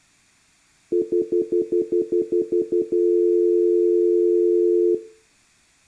Telephone call progress tone (North American plan), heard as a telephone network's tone, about 350, 440 Hz, 0.1 s on and 0.1 s off. Stutter dial tone.